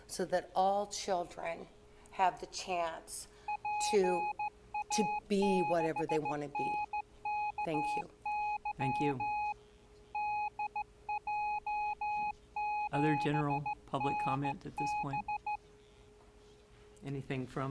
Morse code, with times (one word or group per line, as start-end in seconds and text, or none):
3.5-9.5 PA6NKY
10.1-15.6 DJ7NB